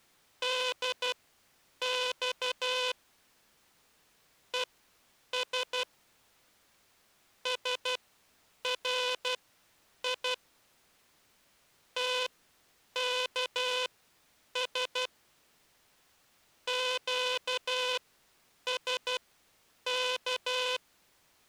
Morse code, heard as a buzzer, machine-sent, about 12 wpm, spaced as for 8 wpm. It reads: DX ES SRI TKS QSK